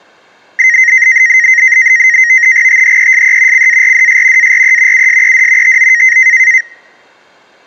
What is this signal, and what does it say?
NAVTEX (SITOR-B), 100 baud, 170 Hz shift, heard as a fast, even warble, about 1950 Hz centre. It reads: THESE CARDS ARE USED TO